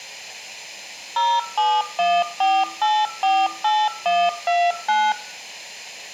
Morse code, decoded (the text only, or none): none